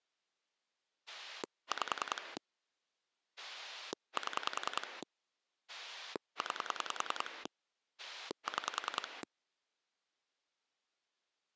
Pulse dialling, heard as a rotary dial, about 10 pulses a second. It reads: 5 7 9 6